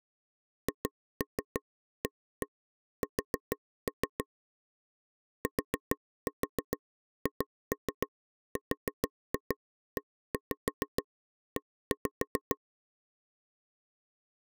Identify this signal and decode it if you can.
Tap code, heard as taps on a table, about 6 knocks a second. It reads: HAS THREE